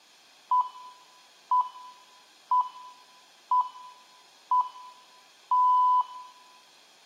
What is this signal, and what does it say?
Radio time signal (six pips, as the Greenwich Time Signal), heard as pips, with room echo.